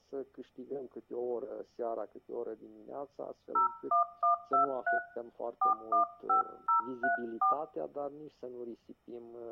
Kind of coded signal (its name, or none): DTMF